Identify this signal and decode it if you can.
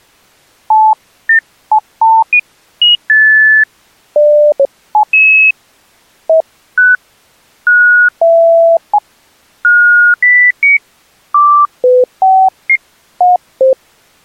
Electronic bleeps of random pitch and length. There is no code.